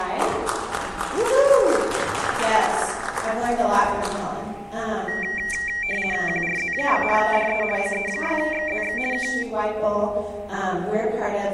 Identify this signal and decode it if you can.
RTTY (50 baud, 450 Hz shift), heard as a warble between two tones, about 2100 Hz centre, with static crashes and a steady whistle near 810 Hz. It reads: QRZ? DE OE6XZX K